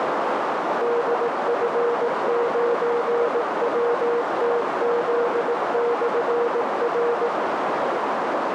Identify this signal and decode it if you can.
Morse code, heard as a keyed tone, machine-sent, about 18 wpm, 470 Hz, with heavy radio static and a narrow filter. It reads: DF9WTZ/R